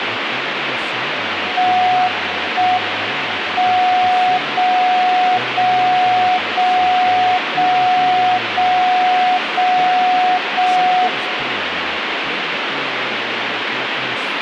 Radio time signal (JJY), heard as a tone whose level steps once a second, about 730 Hz, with radio static and speech in Italian. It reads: 1 M 0 0 0 0 0 0 0 1